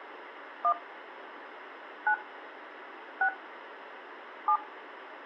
DTMF, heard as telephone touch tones, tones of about 80 ms, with radio hiss. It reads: 1 9 6 7